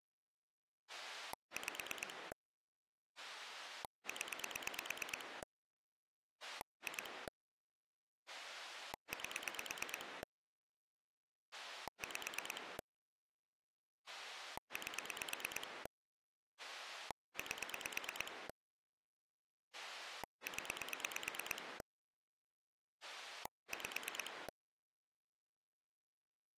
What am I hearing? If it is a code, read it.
Pulse dialling, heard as a rotary dial, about 9 pulses a second. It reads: 5 0 2 8 5 8 8 0 5